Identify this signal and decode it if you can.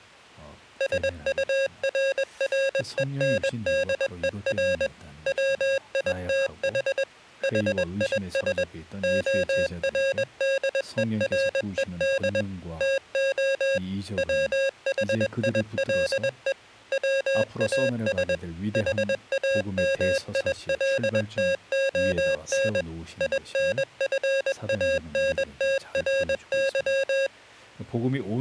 Morse code, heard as electronic beeps, machine-sent, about 21 wpm, 540 Hz. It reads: SURRENDER WITH HIS ORDERED TO WHILE WAS HAMILTON INFANTRY